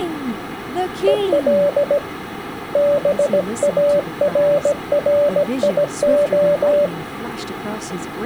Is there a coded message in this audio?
Yes: Morse code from 1.0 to 6.9 s, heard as a keyed tone, hand-sent with a paddle, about 17 wpm, 580 Hz, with speech in English. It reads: EL BARRIO